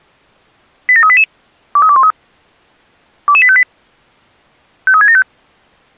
Five-tone selective call (ZVEI), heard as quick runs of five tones, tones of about 70 ms. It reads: 87388 23213 22858 53675